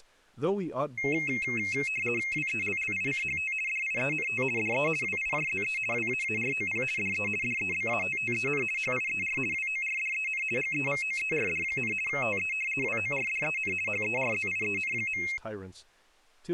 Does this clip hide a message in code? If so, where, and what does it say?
Yes: RTTY (50 baud, 450 Hz shift) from 1.0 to 15.4 s, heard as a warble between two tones, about 2350 Hz centre, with speech in English. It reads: WELLICHT DIENT DE WIJZE WAAROP DE DEBATTEN HIER WORDEN GEVOERD, TE WORDEN HERZIEN.